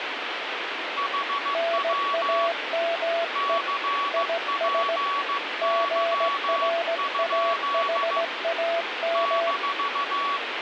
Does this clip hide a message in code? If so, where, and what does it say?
Yes: Morse code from 0.9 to 10.4 s, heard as two keyed tones, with radio static. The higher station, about 15 wpm, 1130 Hz: HW CPY? -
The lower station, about 17 wpm, 670 Hz: NAME IS GRAHAM